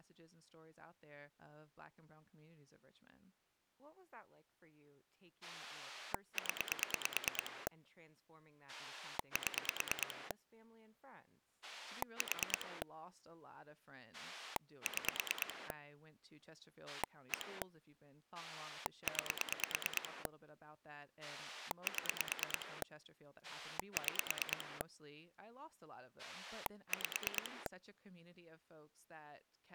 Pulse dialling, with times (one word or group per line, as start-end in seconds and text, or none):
5.4-7.7 0
8.7-10.3 7
11.6-12.8 4
14.1-15.7 6
16.9-17.6 1
18.3-20.3 9
21.2-22.8 7
23.4-24.8 6
26.2-27.7 5